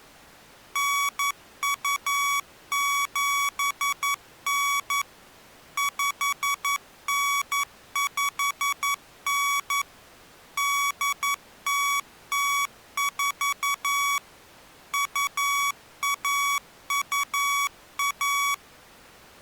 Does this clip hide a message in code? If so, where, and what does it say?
Yes: Morse code (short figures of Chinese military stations) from 0.7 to 18.6 s, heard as electronic beeps, machine-sent, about 11 wpm, 1130 Hz. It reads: 9279 5959 8004 2121